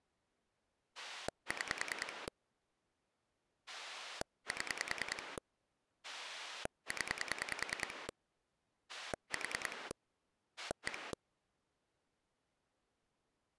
Pulse dialling, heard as a rotary dial, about 10 pulses a second. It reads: 6 7 0 4 1